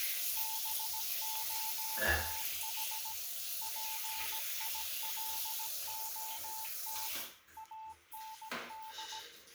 Morse code, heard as a keyed tone, machine-sent, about 17 wpm, 880 Hz, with the noise of a restroom. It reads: BOTH PILOT AND